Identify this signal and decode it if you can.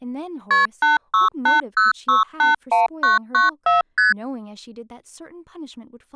Multi-frequency trunk signalling (R1, as on North American trunks), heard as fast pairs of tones, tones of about 150 ms, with speech in English. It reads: KP 8680681994 ST